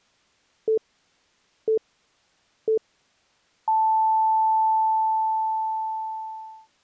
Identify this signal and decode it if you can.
Radio time signal (three low pips and a long one an octave up, as on NHK), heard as pips.